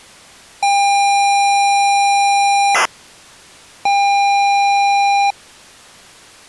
ZX Spectrum tape loading, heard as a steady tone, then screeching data.